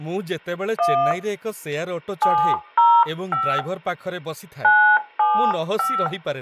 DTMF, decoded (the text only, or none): 1 705 975